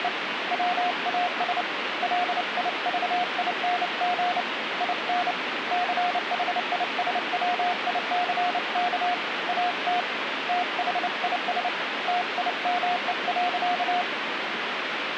Morse code, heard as a keyed tone, hand-sent with a paddle, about 29 wpm, 720 Hz, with radio static. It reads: … WAS LIVING IN CHISWICK AT THIS TIME.